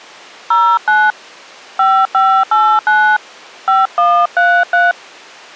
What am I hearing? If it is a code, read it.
DTMF, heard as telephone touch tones, dialled by hand, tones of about 240 ms. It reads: 09 5589 5133